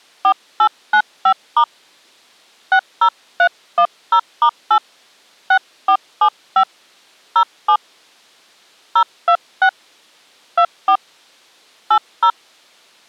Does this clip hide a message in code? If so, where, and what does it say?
Yes: DTMF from 0.2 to 12.3 s, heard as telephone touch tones, dialled by hand, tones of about 80 ms. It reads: 4895* 60310*8 6475 07 026 24 80